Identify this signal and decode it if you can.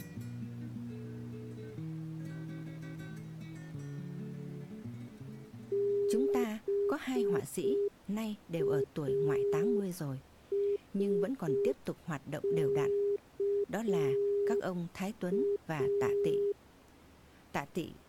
Morse code, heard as a keyed tone, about 5 wpm, 400 Hz. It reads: BASKA